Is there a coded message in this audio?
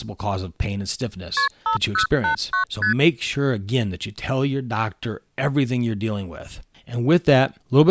Yes: multi-frequency trunk signalling (R1, as on North American trunks) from 1.4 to 2.9 s, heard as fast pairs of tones, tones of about 110 ms, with speech in English. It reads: KP 5089 ST